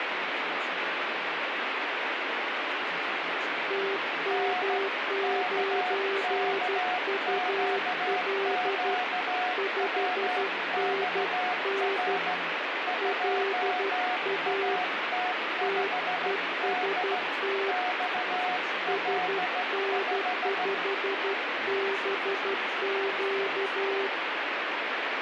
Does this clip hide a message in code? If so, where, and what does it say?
Yes: Morse code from 3.6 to 24.1 s, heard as two keyed tones, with heavy radio static. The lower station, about 12 wpm, 390 Hz: TM9UL 5NN LA TEST SN5BQ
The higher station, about 15 wpm, 730 Hz: N KKQQWXR 2AT5D XL5